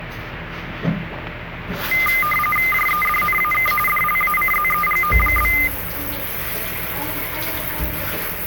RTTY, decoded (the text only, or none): JEDNAK DLACZEGO?